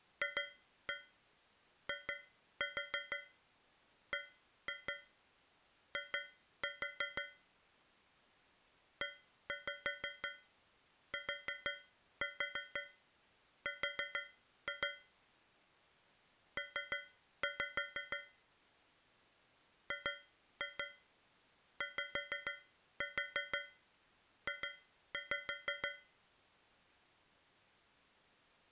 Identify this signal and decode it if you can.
Tap code, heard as taps on a metal pipe, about 6 knocks a second. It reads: FIBI ETR P GYJ